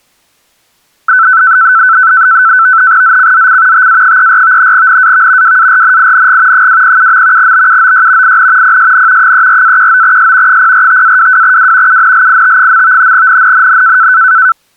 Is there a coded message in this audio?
Yes: NAVTEX (SITOR-B), 100 baud, 170 Hz shift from 1.1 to 14.5 s, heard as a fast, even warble, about 1420 Hz centre. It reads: ZCZC TA34 NAV WARNING 207. BUOY IN PSN 34-19S 045-22W UNLIT. NNNN